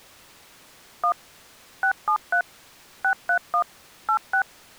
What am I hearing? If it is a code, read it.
DTMF, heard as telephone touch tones, dialled by machine, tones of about 90 ms. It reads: 1 673 631 86